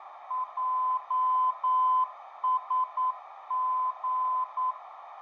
Morse code, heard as a keyed tone, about 9 wpm, 1020 Hz, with radio static and a narrow filter. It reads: JSG